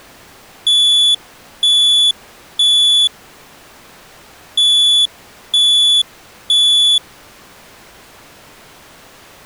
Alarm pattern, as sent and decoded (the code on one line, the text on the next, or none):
3 beeps and a pause
temporal three